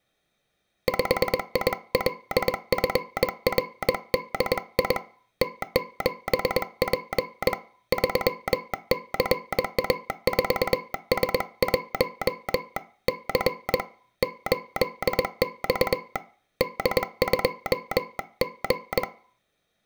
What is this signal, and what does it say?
Morse code, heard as a telegraph sounder, hand-sent with a bug key, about 21 wpm, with room echo. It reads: 5ILFRDI T7P 3CA4S1 C 8X D2G